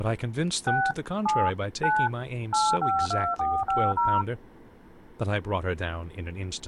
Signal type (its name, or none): DTMF